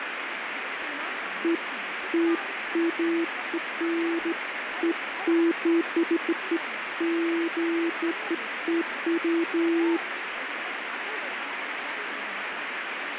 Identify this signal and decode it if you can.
Beeps of irregular length, with radio static and speech in Gujarati. There is no code.